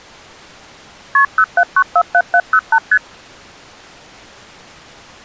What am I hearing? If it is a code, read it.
Multi-frequency trunk signalling (R1, as on North American trunks), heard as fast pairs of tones, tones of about 60 ms. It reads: KP 07947708 ST